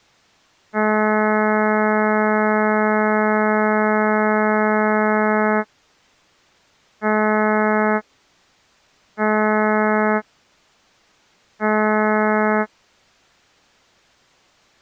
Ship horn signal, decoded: 1 long, 3 short

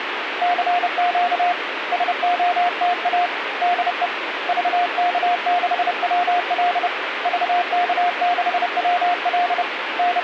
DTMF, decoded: none

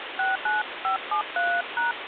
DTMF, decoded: 69573#

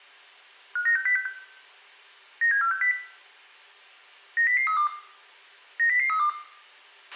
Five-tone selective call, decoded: 59606 97460 90032 90032

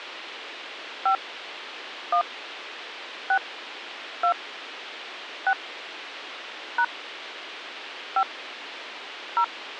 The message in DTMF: 5 1 6 2 6 # 5 0

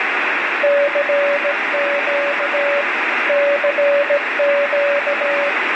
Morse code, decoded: CQ CQ

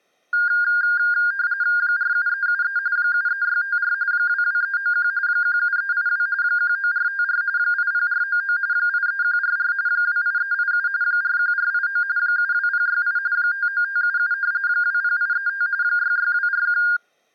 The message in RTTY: 47373 73654 22391 17382 19454 80499 83144 28387 41489 72068 59577 20835 66241

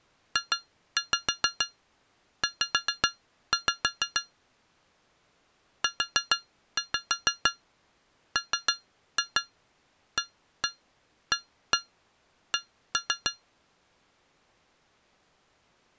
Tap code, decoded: JZ UMAAC

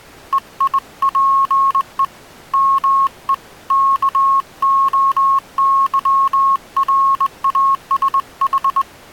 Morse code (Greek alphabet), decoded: ΕΙΠΕ ΜΕ ΚΟΥΡΑΣΗ

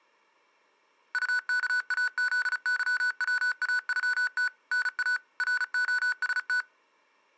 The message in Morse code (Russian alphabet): УКАЗЫВАЮТ НА РОСТ

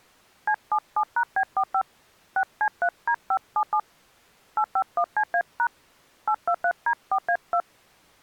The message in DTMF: C77#B45 6C3D577 851CA# 823D4A2

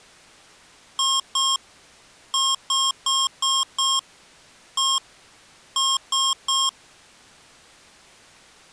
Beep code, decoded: 2-5-1-3

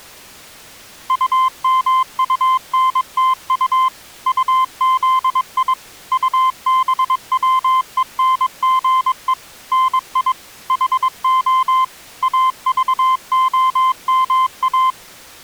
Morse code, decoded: UMUNTU UZI UBWENGE NI HO AVOMA

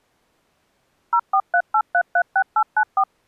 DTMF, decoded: 0438336894

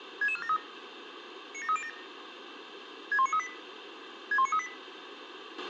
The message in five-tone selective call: 66473 97307 61938 61938

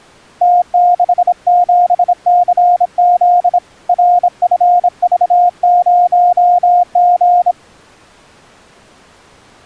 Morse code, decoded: T67CZ RFV0G

